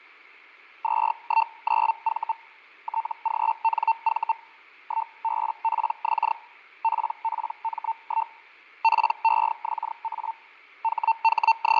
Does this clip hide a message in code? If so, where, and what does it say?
Yes: Hellschreiber (Feld-Hell, 122.5 baud) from 0.8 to 11.8 s, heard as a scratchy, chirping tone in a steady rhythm, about 900 Hz, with fading. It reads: 219V TGNV 1BPX PPM1 PEXA …